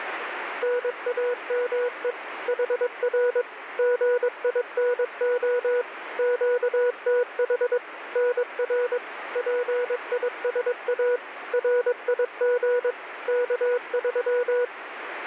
Morse code, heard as a keyed tone, machine-sent, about 22 wpm, 490 Hz, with radio static. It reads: NAME HR GINO QTH NR PISA RIG K3